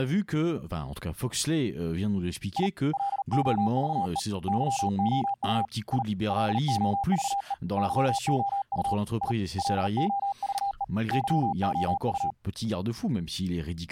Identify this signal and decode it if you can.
Morse code, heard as a keyed tone, hand-sent with a paddle, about 39 wpm, 800 Hz, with speech in French. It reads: I LOVE YOU I LOVE YOU I LOVE YOU